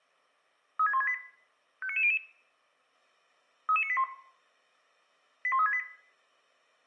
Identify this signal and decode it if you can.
Five-tone selective call (ZVEI), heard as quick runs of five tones, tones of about 70 ms, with room echo. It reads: 36168 59900 33981 81368